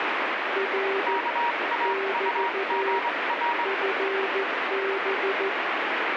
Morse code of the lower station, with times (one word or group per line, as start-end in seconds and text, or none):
0.6-1.2 R
1.9-3.0 <BT>
3.7-5.5 FB